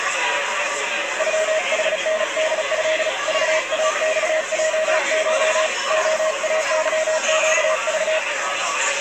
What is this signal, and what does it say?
Morse code (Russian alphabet), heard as a keyed tone, hand-sent with a paddle, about 36 wpm, 630 Hz, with the noise of a crowd indoors. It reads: ЮХНДЭ ЖАЬЙШ ОАЫЩЖ